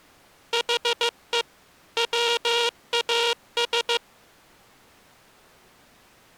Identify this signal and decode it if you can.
Morse code, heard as a buzzer, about 15 wpm. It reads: HE WAS